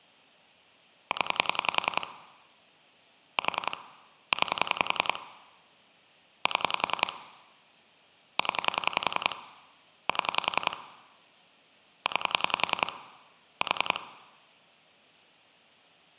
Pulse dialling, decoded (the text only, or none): 0 4 9 7 0 7 9 4